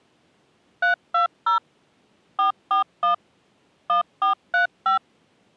DTMF, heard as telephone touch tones, dialled by machine, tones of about 120 ms. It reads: 320 441 1435